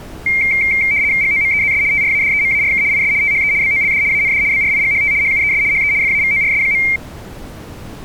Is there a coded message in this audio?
Yes: RTTY (75 baud, 170 Hz shift) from 0.3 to 7.0 s, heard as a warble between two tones, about 2200 Hz centre. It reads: GOMEZS TRADEMARK IS THE BOLD AND BRIGHT HUES HE FAVORS.